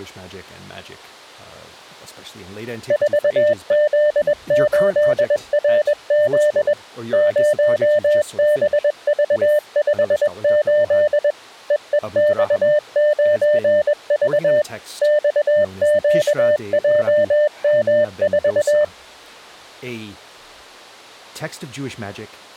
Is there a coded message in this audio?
Yes: Morse code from 2.8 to 18.9 s, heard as a keyed tone, machine-sent, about 21 wpm, 600 Hz. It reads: 4Z8RZ 0BV58 EEX9V XQJM4